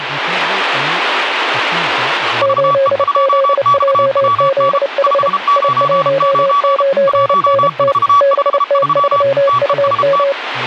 Morse code, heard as two keyed tones, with radio static and speech in Santali. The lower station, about 29 wpm, 540 Hz: 8ZJZH I19NT BT3UM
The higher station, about 33 wpm, 1140 Hz: VE2XWN 599 1453 TEST